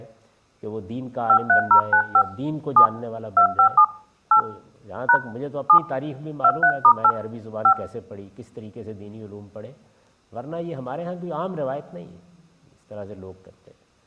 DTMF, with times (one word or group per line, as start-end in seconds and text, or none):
1.3-2.2 53095
2.8-2.9 7
3.4-3.8 257
4.3-4.4 8
5.1-5.2 #
5.7-5.8 7
6.4-7.1 23*8
7.6-7.7 5